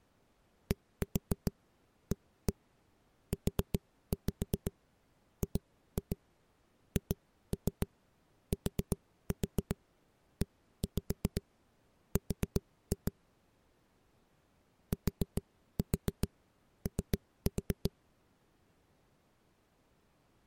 Tap code, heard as knocks on a wall, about 7 knocks a second. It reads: DAUGHTER TO